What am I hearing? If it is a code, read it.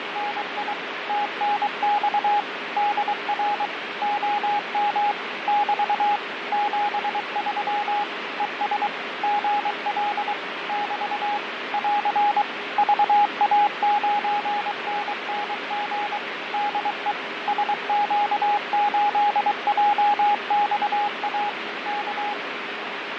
Morse code, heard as a keyed tone, machine-sent, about 23 wpm, 830 Hz, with radio static and fading. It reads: … TNX DR OM <BT> 73 ES GL <BT> <AR> VA9NNG DE SQ8JXA K